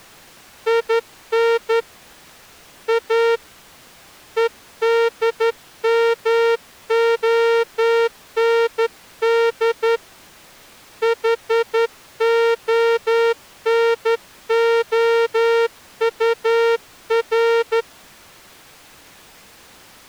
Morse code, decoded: IN A EDMOND HONOUR

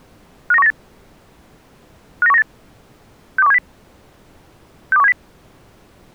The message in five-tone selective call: 59198 59198 62170 62170

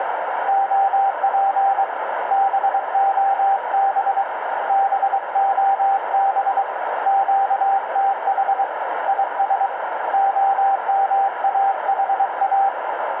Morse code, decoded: OP BOB BOB QTH IS OMAHA

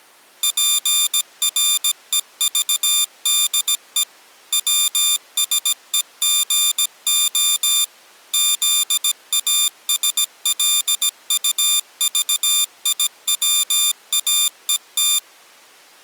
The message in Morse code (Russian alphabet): ПРЕЖДЕ ВСЕГО ЗАСЛУЖИВАЕТ

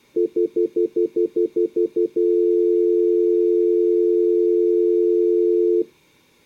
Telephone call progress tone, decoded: stutter dial tone

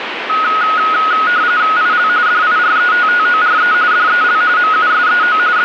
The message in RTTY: IL DIRETTORE DEL MUSEO …

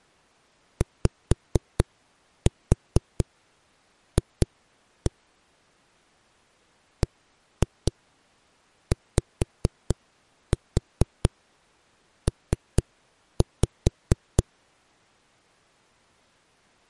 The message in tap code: YF BYP

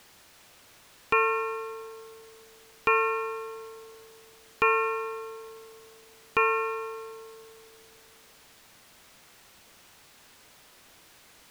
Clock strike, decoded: 4

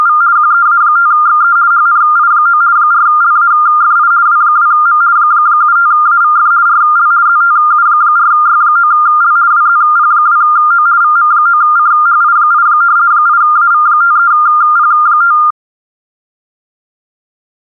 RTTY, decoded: … QEA5XE HNI9 4LAFI W2M 75AVF RL ZTU4Y9L WZP2O VM9CHI8 8AV53P5

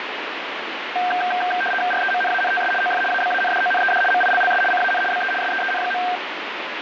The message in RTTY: REMNANTS OF ABANDONED MILLS CAN BE SEEN.

